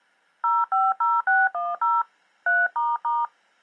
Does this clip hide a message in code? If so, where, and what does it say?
Yes: DTMF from 0.4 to 3.2 s, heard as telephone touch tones, dialled by hand, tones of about 200 ms. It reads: 050610 3**